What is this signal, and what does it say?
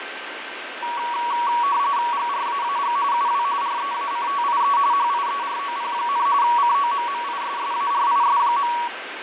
RTTY (45.45 baud, 170 Hz shift), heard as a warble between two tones, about 1040 Hz centre, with radio static, fading and a steady whistle near 1560 Hz. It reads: GRAAG UW REACTIE HIEROP, COMMISSARIS.